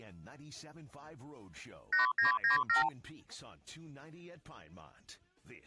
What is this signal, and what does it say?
Multi-frequency trunk signalling (R2, with the far end's replies), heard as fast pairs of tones, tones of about 130 ms. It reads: 8997